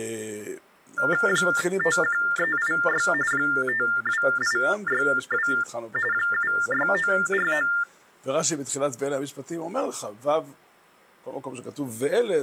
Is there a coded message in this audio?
Yes: TTY/TDD text telephone tones (45.45 baud Baudot) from 1.0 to 7.8 s, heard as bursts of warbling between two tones, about 400 Hz shift, 1600 Hz centre. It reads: 51386 52862 76949